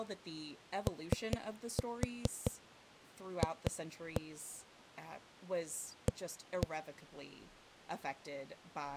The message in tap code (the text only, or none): OF A